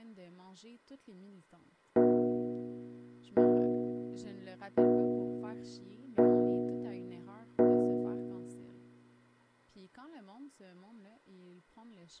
Clock strike, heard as a bell, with speech in French. 5. Five o'clock.